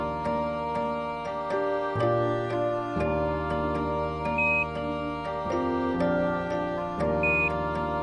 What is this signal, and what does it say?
Quindar tones, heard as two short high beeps.